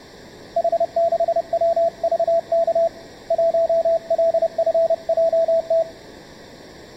Morse code, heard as a keyed tone, hand-sent with a paddle, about 30 wpm, 670 Hz. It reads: H6WVK 1LFJT